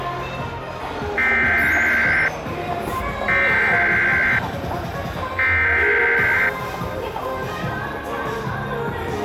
Emergency Alert System (SAME) tones (header bursts), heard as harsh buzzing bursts, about 520.83 baud, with the noise of a crowd indoors.